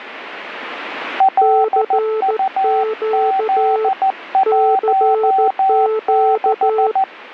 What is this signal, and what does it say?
Morse code, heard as two keyed tones, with radio static. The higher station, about 14 wpm, 770 Hz: LUZ16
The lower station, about 14 wpm, 440 Hz: CQ CQ